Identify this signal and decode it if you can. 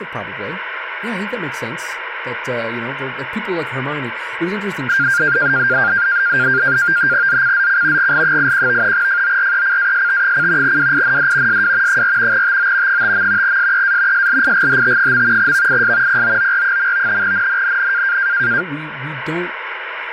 NAVTEX (SITOR-B), 100 baud, 170 Hz shift, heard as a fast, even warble, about 1500 Hz centre, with radio static and speech in English. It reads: ZCZC GL81 FORECAST: WIND SW 4 TO 5. SEA SLIGHT. VIS POOR. NNNN